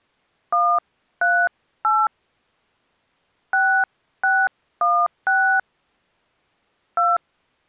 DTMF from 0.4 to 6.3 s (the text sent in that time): 138 6616